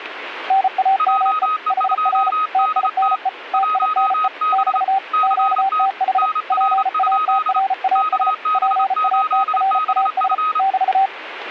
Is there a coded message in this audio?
Yes: Morse code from 0.4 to 11.1 s, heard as two keyed tones, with radio static. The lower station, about 34 wpm, 780 Hz: NAME HR TINE TINE <BT> QTH PATRAS PATRAS <BT>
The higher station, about 28 wpm, 1260 Hz: JE2DT 1B CT NR? KB8BF